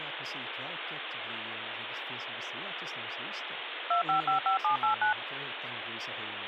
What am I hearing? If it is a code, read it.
DTMF, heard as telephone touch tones, dialled by machine, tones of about 110 ms, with phone line noise and speech in Swedish. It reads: 2555789